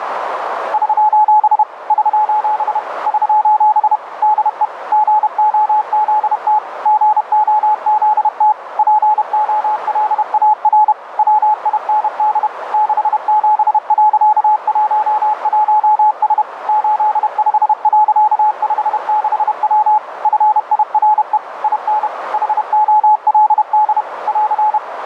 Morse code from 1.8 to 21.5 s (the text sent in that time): <SOS> <SOS> DE GOZT GOZT POLAR WIND 67.11S 85.56W FIRE